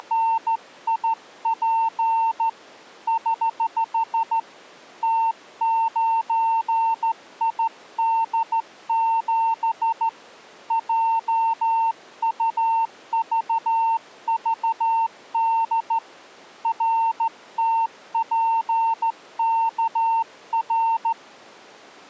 Morse code, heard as a keyed tone, hand-sent with a straight key, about 14 wpm, 910 Hz. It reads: … <HH> T9ID7 JUVVD RTPKR